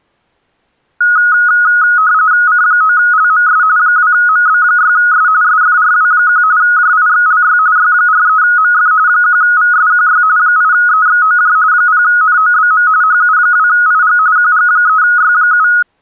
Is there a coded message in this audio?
Yes: RTTY (45.45 baud, 170 Hz shift) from 1.0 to 15.8 s, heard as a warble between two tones, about 1360 Hz centre. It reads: C9LMS 2MB6S SFRW1 JIXLY Y43MF 1VSQY 8EXOJ 0NOBM HU2IG QG3Y7